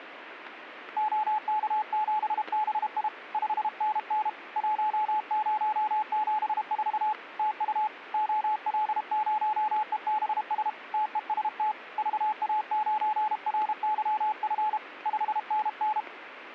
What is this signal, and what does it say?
Morse code, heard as a keyed tone, hand-sent with a paddle, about 32 wpm, 860 Hz, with radio static. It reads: OK7BI 5NN 1074 TU OL0EBS TEST VA9RYF 5NN